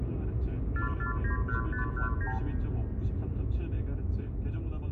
Multi-frequency trunk signalling (R2, with the far end's replies), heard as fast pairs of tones, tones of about 120 ms, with room echo and the noise inside a car. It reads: 4491519